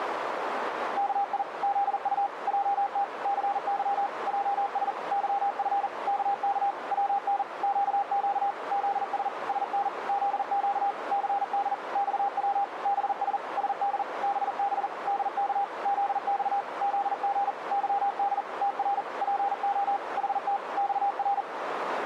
Morse code, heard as a keyed tone, machine-sent, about 40 wpm, 800 Hz, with radio static and a narrow filter. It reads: KI ZU JT CY JS YF KK WN QQ ZS SN ZQ CD XW BS SD BB DK ZX ZG YD TR PO HT XR